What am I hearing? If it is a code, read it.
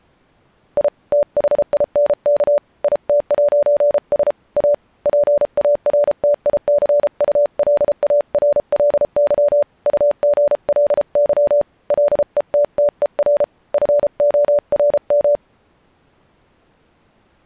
Morse code, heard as a keyed tone, hand-sent with a paddle, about 33 wpm, 580 Hz. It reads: I THINK IT'S A PARTICULARLY UGLY LETTER FORM